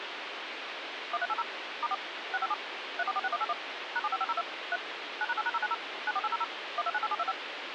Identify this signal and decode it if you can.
DTMF, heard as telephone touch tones, dialled by machine, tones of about 40 ms, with phone line noise. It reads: 1380 *4 657 3446181 #75502 3 9#8#090 94800 1298725